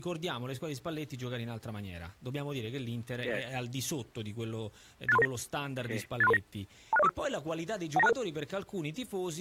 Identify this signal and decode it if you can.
Five-tone selective call (EIA), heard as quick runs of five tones, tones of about 30 ms. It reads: 86339 86339 26045 19266